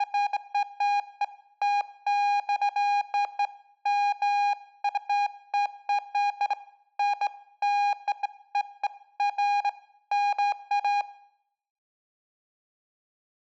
Beeps of irregular length, with room echo. There is no code.